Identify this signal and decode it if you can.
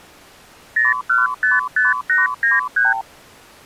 Multi-frequency trunk signalling (R2, with the far end's replies), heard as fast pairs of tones, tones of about 170 ms. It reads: 0155893